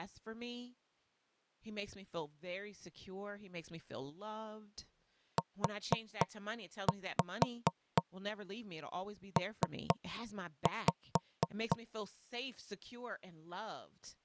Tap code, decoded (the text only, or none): UP